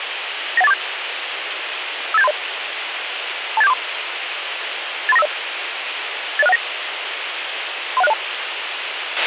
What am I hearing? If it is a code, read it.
Five-tone selective call (EIA), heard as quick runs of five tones, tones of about 30 ms, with radio hiss and a squelch burst at the end. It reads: 91847 58730 28743 83950 80619 31602